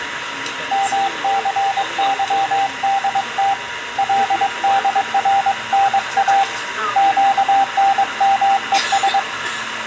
Morse code, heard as a keyed tone, hand-sent with a paddle, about 22 wpm, 790 Hz, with radio static, room echo and the noise inside a bus. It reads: MCYDT LDRNA QNMES